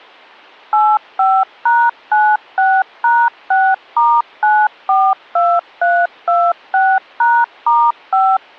DTMF, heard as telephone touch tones, dialled by machine, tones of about 240 ms. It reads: 85#96#6*942326#*5